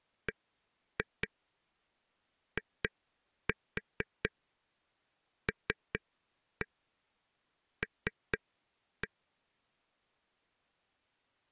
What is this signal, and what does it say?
Tap code, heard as taps on a table, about 4 knocks a second. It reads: BILL